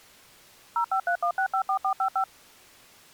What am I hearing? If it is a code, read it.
DTMF, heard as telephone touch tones, dialled by machine, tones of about 90 ms. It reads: 0531654455